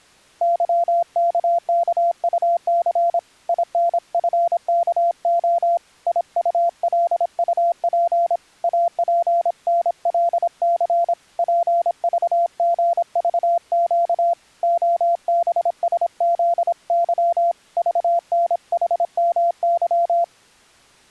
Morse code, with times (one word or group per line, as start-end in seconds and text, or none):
0.4-3.2 YKKUC
3.5-5.8 INFKO
6.1-8.4 IULUP
8.6-11.1 APNLC
11.4-14.3 PVGVQ
14.6-17.5 OBSZY
17.8-20.2 VNHMY